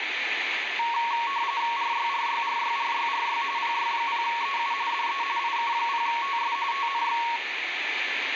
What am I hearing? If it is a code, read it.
RTTY (45.45 baud, 170 Hz shift), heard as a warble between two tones, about 1020 Hz centre, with radio static. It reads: RYRYRYRYRY PY0EU DE IK0TS TNX